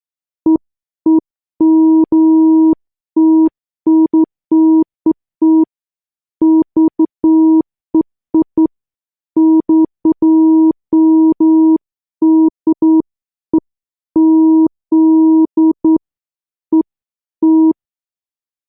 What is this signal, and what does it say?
Beeps of irregular length. There is no code.